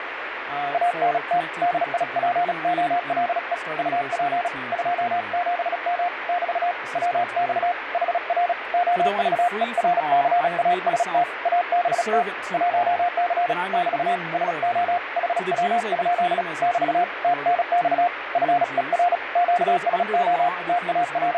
Morse code, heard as a keyed tone, hand-sent with a paddle, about 36 wpm, 710 Hz, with radio static and speech in English. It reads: ANT DIPOLE UP 27M <BT> WX HR OVERCAST ABT 1C <BT> SO HW? <BT> TNX FER QSO …